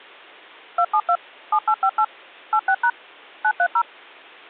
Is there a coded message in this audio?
Yes: DTMF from 0.8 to 3.8 s, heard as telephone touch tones, dialled by machine, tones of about 70 ms. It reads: 272 7858 86# 930